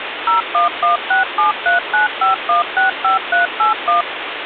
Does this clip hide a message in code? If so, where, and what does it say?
Yes: DTMF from 0.3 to 4.0 s, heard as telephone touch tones, dialled by machine, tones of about 130 ms, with phone line noise. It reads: 01167395165381